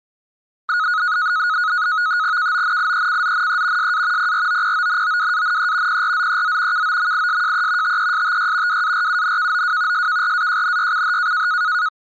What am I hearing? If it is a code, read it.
NAVTEX (SITOR-B), 100 baud, 170 Hz shift, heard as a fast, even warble, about 1360 Hz centre. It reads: KONIECZNE SA PROPONOWANE PRZEZ KOMISJE TESTY WARUNKOW SKRAJNYCH